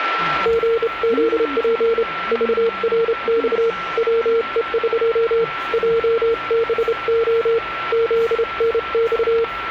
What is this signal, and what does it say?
Morse code (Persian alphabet), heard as a keyed tone, hand-sent with a straight key, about 28 wpm, 460 Hz, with radio static, a steady whistle near 1350 Hz and the noise of a restaurant. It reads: ژزپ ذرخ وهق جبع زنخ